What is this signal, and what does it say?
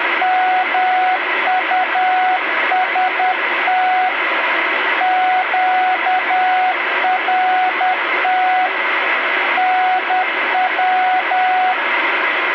Morse code, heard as a keyed tone, hand-sent with a paddle, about 10 wpm, 740 Hz, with radio static. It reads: MUST QRT NW